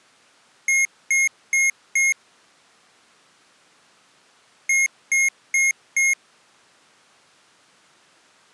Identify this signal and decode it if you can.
Beep code, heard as beeps from a small speaker, played twice, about 2150 Hz. 4 short. In AMI BIOS tables: system timer failure; in Dell tables: memory read or write failure.